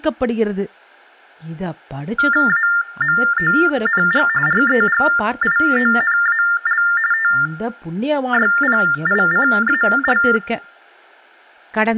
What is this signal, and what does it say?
TTY/TDD text telephone tones (45.45 baud Baudot), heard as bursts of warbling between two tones, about 400 Hz shift, 1600 Hz centre, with room echo and speech in Tamil. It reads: AMONG REGIONAL TYPICAL